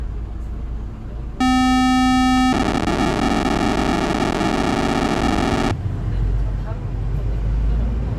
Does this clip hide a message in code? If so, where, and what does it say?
Yes: POCSAG pager data (512 baud) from 1.4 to 5.7 s, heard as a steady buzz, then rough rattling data, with the noise inside a bus.